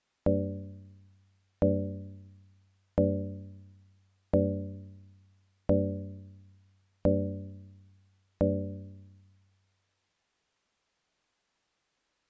Clock strike, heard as a bell. 7. Seven o'clock.